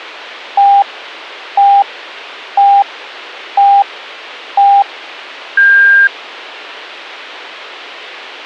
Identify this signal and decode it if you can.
Radio time signal (five pips and a higher one, as on Chinese radio), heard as pips, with a squelch burst at the end.